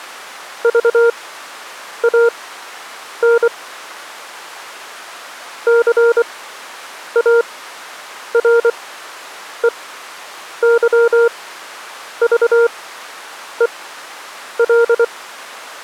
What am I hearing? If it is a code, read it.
Morse code, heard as a keyed tone, machine-sent, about 24 wpm, spaced as for 8 wpm, 470 Hz. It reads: VAN CAREYVEL